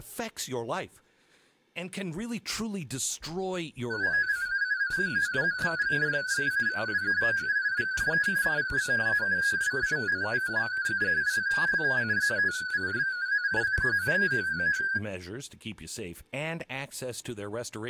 Multi-tone FSK (Olivia or MFSK type), about 250 Hz wide, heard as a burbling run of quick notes, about 31.25 baud, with speech in English.